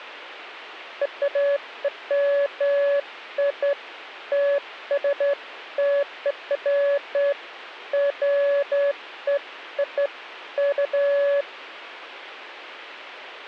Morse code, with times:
none

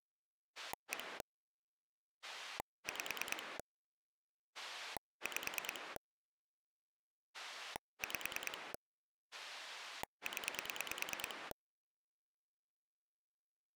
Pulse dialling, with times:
0.6-1.2 1
2.2-3.6 5
4.5-6.0 5
7.3-8.7 5
9.3-11.5 0

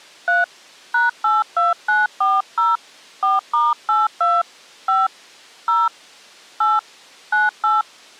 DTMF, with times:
0.3-0.4 3
0.9-2.8 #82940
3.2-4.4 4*82
4.9-5.1 5
5.7-5.9 0
6.6-6.8 8
7.3-7.8 98

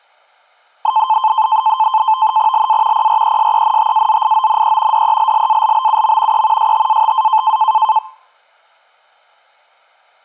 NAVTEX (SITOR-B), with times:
2.5-3.1 LA
2.9-5.0 PRESENTAZIONE
4.9-6.4 DELLALBUM
6.3-6.7 E
6.6-7.6 STATA

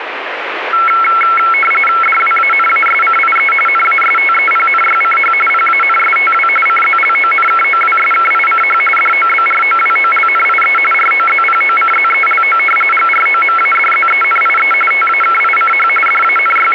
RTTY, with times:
2.0-3.5 DWANASCIE
3.7-5.3 NASTEPNYCH
5.5-6.5 PANSTW
6.7-8.8 CZLONKOWSKICH
9.0-10.8 DOBROWOLNIE
10.9-12.6 ROZPOCZELO
12.9-14.7 GROMADZENIE
14.9-15.9 TAKICH
16.1-16.7 …

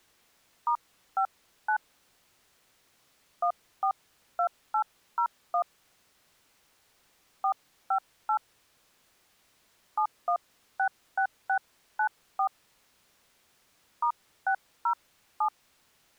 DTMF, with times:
0.7-1.8 *59
3.4-5.6 142801
7.4-8.4 458
10.0-12.5 7166694
14.0-15.5 *607

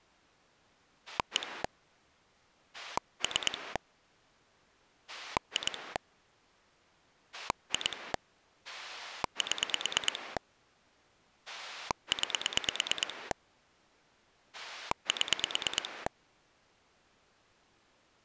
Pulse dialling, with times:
1.1-1.6 1
2.7-3.8 3
5.1-6.0 2
7.3-8.1 2
8.6-10.4 7
11.5-13.3 9
14.5-16.1 7

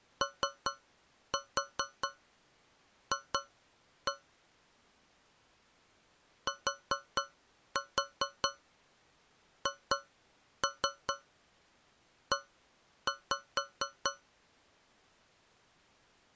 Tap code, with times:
0.2-4.1 OF
6.5-14.1 THE

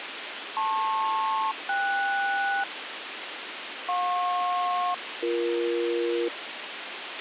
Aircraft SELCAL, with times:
0.6-2.6 LP-KS
3.9-6.3 JP-BE

